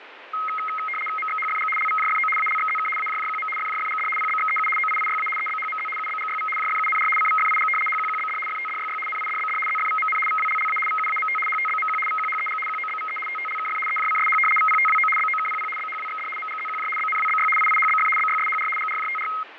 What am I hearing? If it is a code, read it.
RTTY (75 baud, 850 Hz shift), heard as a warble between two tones, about 1700 Hz centre, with radio static and fading. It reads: MXHFG LVJFO ALXZK AJJQM FJFGD PBXEU OIIYA EBHMZ UBGYV JFUNR CVFIG HQQBD FTDYY NIDBD ZFVMN VWLLA VUAMT HTBMQ VQHEG QOBVE TTLKF EJCSH VPTWO BOKPP BHWXD MGZQJ BNWBY IIHBF BYSHR GRJTR